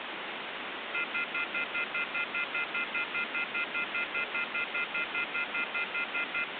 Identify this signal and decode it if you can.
Telephone call progress tone (North American plan), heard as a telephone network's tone, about 1400, 2050, 2450, 2600 Hz, 0.1 s on and 0.1 s off, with phone line noise. Off-hook warning tone.